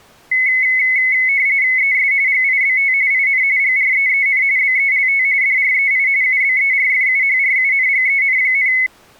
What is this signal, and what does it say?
RTTY (45.45 baud, 170 Hz shift), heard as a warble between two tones, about 2100 Hz centre. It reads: ES GIBT IN GREEN BELT DREI UBERFUHRUNGEN,